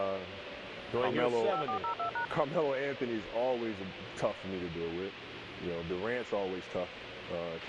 DTMF, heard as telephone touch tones, dialled by machine, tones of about 100 ms, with radio hiss and a squelch burst at the end. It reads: 5402#